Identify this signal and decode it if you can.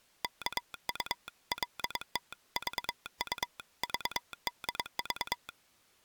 Morse code (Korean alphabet), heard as a telegraph sounder, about 22 wpm. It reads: 이거리를